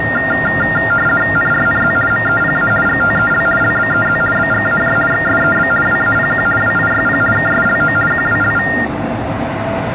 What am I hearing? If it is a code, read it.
RTTY (50 baud, 450 Hz shift), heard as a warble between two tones, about 1600 Hz centre, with the noise inside a lift. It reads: NRNZ MEPA GTEL LBEZ BGAJ XSEB WAPQ WIYP KSLO QWLV